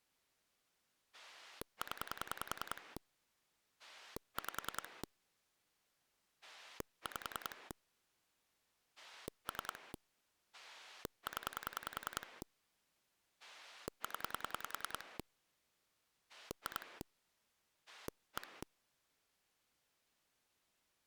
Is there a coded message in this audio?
Yes: pulse dialling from 1.1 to 18.6 s, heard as a rotary dial, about 10 pulses a second. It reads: 0 5 5 3 0 0 2 1